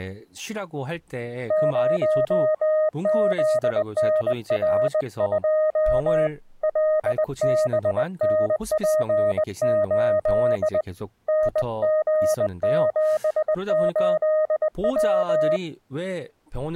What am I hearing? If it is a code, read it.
Morse code, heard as a keyed tone, hand-sent with a bug key, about 20 wpm, 620 Hz, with speech in Korean. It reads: 0ZNR2 LBNP8 NG78W